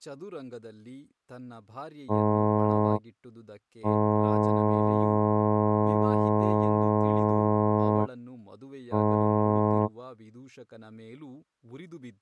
Ship horn signal, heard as a ship's horn, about 110 Hz, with speech in Kannada. 1 short, 1 long, 1 short. At sea: a vessel at anchor warns of its position.